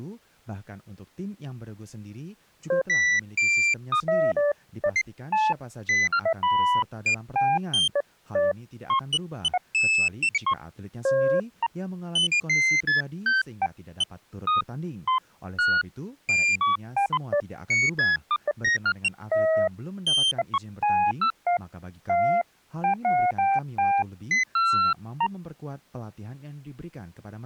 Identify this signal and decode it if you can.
Electronic bleeps of random pitch and length, with speech in Indonesian. There is no code.